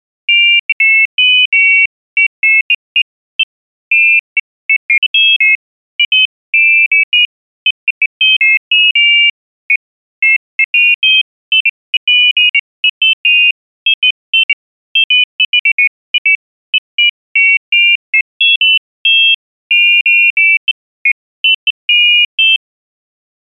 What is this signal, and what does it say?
Pairs of high tones at irregular times. There is no code.